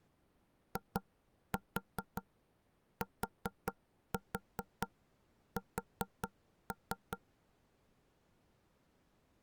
Tap code, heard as knocks on wood, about 4 knocks a second. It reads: ITS